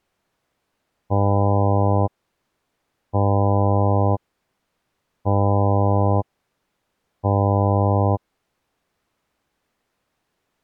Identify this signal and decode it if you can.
Ship horn signal, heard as a ship's horn, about 100 Hz. 4 short. At sea: a pilot vessel's identity signal in fog.